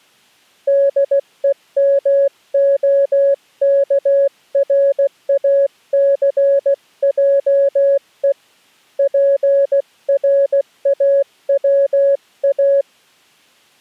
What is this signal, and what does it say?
Morse code, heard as a keyed tone, hand-sent with a paddle, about 16 wpm, 560 Hz. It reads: DEMOKRACJE PRAWA